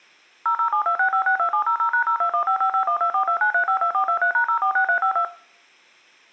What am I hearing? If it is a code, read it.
DTMF, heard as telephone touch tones, dialled by machine, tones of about 90 ms, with room echo. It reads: 00726562700#02155512429352423#046352